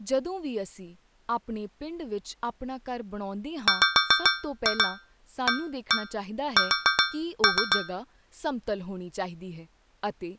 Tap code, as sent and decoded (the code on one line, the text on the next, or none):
5-2 1-1 4-3
WAS